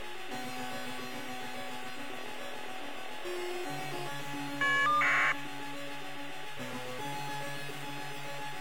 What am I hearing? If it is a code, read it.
Caller ID data burst, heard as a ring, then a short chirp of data, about 1200 baud, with phone line noise.